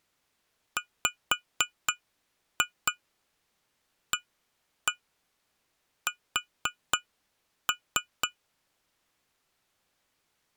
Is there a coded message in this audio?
Yes: tap code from 0.8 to 8.4 s, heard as taps on glass, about 4 knocks a second. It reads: WAS